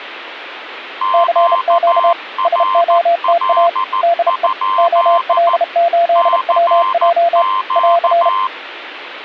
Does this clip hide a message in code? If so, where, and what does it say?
Yes: Morse code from 1.0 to 8.5 s, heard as two keyed tones. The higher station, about 14 wpm, 1040 Hz: QRL? CQ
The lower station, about 32 wpm, 680 Hz: CQ SOTA DE OL8WJ <AR>